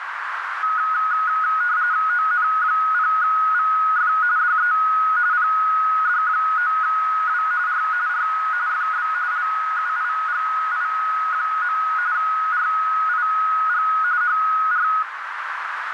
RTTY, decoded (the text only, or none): ON0VF DE PD9W R R FB LUIGI. RIG HR